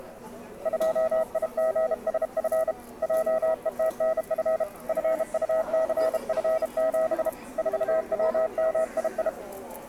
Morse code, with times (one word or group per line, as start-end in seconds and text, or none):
0.7-2.7 2IGSF
3.0-4.6 JETNF
4.9-7.3 FUCF7
7.6-9.3 4WMII